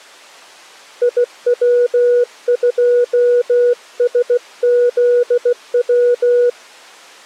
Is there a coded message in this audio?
Yes: Morse code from 1.0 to 6.6 s, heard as a keyed tone, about 16 wpm, 490 Hz. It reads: IW2SZW